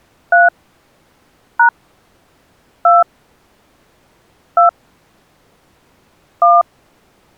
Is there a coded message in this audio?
Yes: DTMF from 0.3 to 6.6 s, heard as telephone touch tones, dialled by hand, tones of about 150 ms. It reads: 3 # 2 2 1